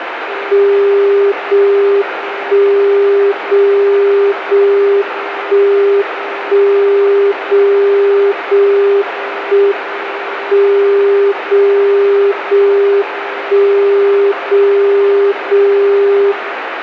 Radio time signal (JJY), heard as a tone whose level steps once a second, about 400 Hz, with radio static and room echo. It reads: 0 1 0 0 1 1 0 0 1 M 0 0 1 0 0 0